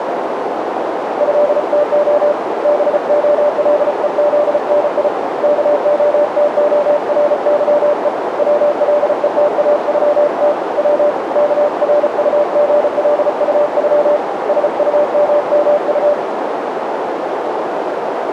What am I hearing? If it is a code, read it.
Morse code (Russian alphabet), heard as a keyed tone, hand-sent with a paddle, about 34 wpm, 590 Hz, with heavy radio static and a narrow filter. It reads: ЭТО БОЛЕЗНИ КОТОРЫЕ ВЛЕТАЮТ В КРУГЛУЮ СУММУ